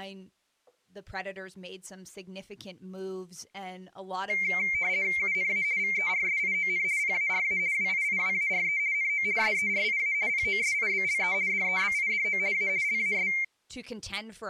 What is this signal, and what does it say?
RTTY (50 baud, 170 Hz shift), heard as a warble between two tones, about 2200 Hz centre. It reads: UNA VERSION PARA WIIWARE NO SERIA POSIBLE DEBIDO A LAS